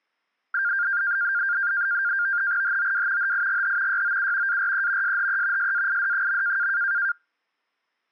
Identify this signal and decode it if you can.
NAVTEX (SITOR-B), 100 baud, 170 Hz shift, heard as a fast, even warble, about 1500 Hz centre. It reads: HOW HIGH YOU ARE SHE SAID.